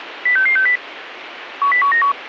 Five-tone selective call (CCIR), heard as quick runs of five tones, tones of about 100 ms, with radio hiss. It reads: 06660 10191